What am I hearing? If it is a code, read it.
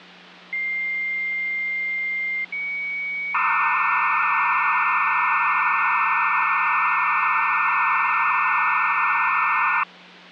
Dial-up modem handshake (low-speed, two carriers), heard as two whistles, then hiss, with hum.